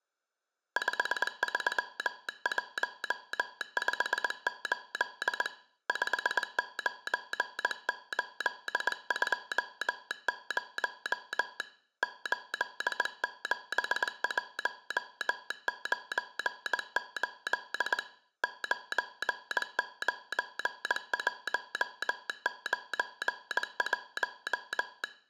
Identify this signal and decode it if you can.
Morse code, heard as a telegraph sounder, hand-sent with a straight key, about 20 wpm, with room echo. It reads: 53158 59820 87198 99191